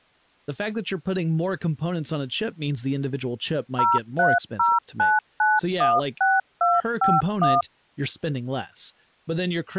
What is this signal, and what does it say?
DTMF, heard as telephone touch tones, dialled by machine, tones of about 200 ms, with speech in English. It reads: 0309916251